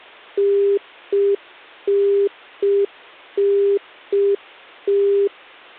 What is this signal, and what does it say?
Telephone call progress tone (UK plan), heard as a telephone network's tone, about 400 Hz. Congestion tone.